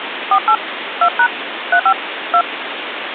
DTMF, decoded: 48 2# 35 2

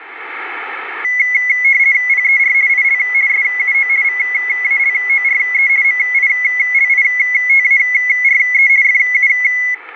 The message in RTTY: PER IL SUO VALORE MILITARE FU

